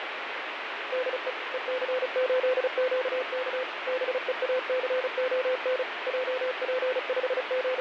Morse code, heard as a keyed tone, machine-sent, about 35 wpm, 510 Hz, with radio static. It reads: DE EC8QK BEACON …